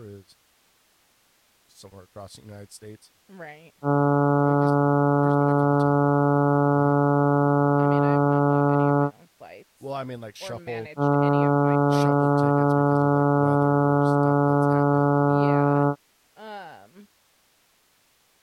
Ship horn signal, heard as a ship's horn, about 140 Hz, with speech in English. 2 long. At sea: a vessel under power that has stopped in fog.